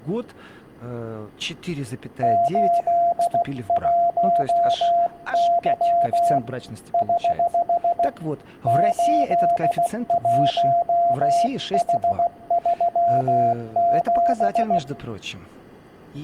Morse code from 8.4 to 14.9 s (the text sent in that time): 81H37